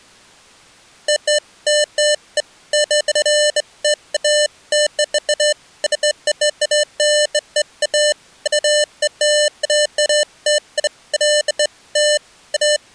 Beeps of irregular length. There is no code.